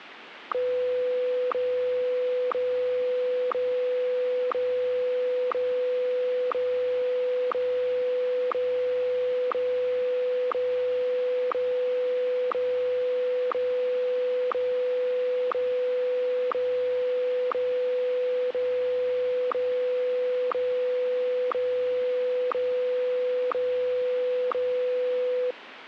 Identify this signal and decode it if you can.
Radio time signal (WWVH, Hawaii), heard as ticks, one a second, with radio static.